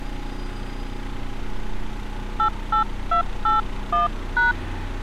DTMF, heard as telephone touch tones, dialled by hand, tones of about 130 ms, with street noise. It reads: 88281#